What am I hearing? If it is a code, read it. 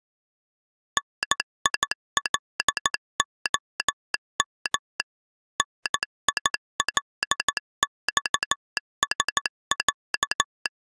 Morse code (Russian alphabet), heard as a telegraph sounder, machine-sent, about 14 wpm. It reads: НИЛОМ НИЛЬСЯ